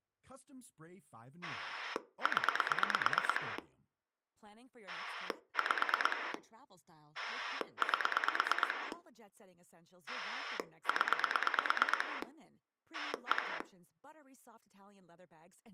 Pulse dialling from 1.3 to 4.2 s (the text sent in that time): 0